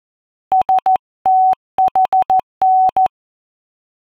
Morse code (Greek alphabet), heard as a keyed tone, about 14 wpm, 750 Hz. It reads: ΣΤΗΝ